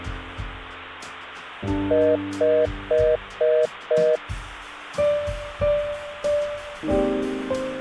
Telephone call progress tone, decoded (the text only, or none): congestion tone